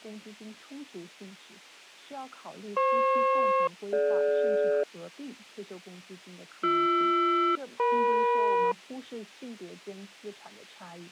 Aircraft SELCAL, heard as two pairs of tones. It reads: FP-DG BR-EM